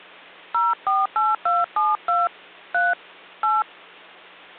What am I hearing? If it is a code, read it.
DTMF, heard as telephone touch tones, dialled by hand, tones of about 190 ms, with hum. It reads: 048272 3 8